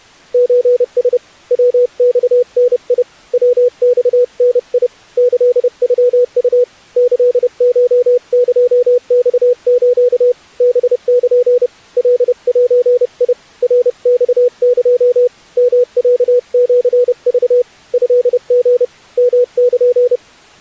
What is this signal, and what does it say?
Morse code (Japanese Wabun code), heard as a keyed tone, hand-sent with a paddle, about 30 wpm, 490 Hz. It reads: ソラ ヤマダ ヤマダ キノウ キコエマス ハル カゼ ナマエ ヨロシク トリ ヨル